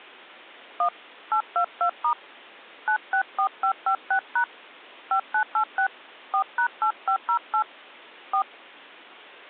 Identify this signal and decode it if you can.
DTMF, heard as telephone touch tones, dialled by hand, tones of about 90 ms. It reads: 1 822* 964556# 5986 4#8508 4